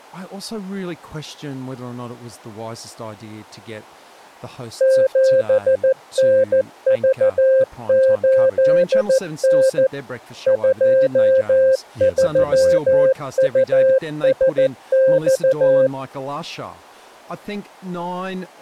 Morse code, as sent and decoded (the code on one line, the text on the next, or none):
--... -. ...- ---.. -. / ..--- ...-- ..- ... -..-
7NV8N 23USX